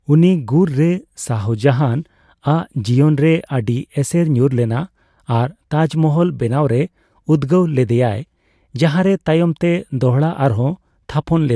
Speech in Santali. There is no code.